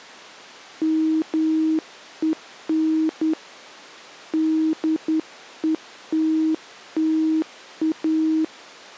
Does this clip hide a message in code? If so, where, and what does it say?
Yes: Morse code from 0.8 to 8.5 s, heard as a keyed tone, hand-sent with a straight key, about 10 wpm, 320 Hz. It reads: MEN DETTA